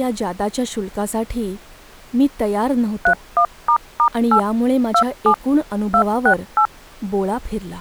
DTMF, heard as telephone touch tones, dialled by machine, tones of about 80 ms, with speech in Marathi. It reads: 31**8 27 268